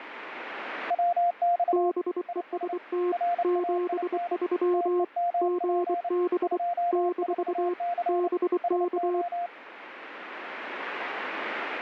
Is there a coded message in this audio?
Yes: Morse code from 0.8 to 9.5 s, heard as two keyed tones, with radio static. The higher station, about 29 wpm, 700 Hz: WX IS RAIN TEMP 24C SO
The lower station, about 24 wpm, 360 Hz: BEST 73 GB - BK